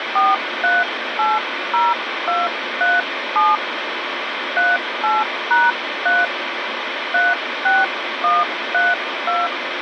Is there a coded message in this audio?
Yes: DTMF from 0.2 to 9.5 s, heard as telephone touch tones, dialled by hand, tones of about 190 ms, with radio hiss. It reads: 4380237 38#3 36132